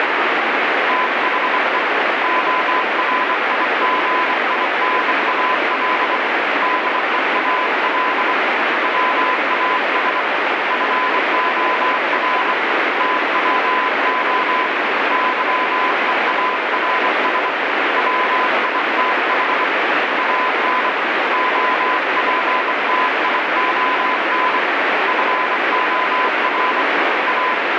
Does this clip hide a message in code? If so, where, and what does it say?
Yes: Morse code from 0.8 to 27.6 s, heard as a keyed tone, hand-sent with a bug key, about 24 wpm, 1010 Hz, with heavy radio static. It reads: THE ORIGINAL DEAL WAS FOR TWO YEARS WITH AN OPTION FOR A